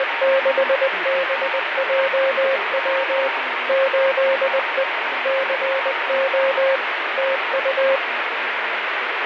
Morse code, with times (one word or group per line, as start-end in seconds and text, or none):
0.0-3.3 …
3.7-4.8 8E
5.3-6.8 CO
7.2-8.0 TU